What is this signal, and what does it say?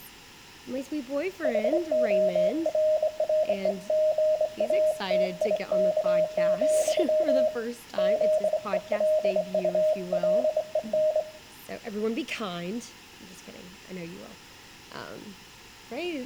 Morse code, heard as a keyed tone, hand-sent with a straight key, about 24 wpm, 620 Hz, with room echo. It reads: HORREGATIK, ZELULEN